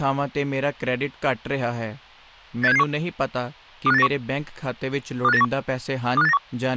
Five-tone selective call (EEA), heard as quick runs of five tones, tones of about 40 ms, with speech in Punjabi. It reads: 86771 25891 25891 25891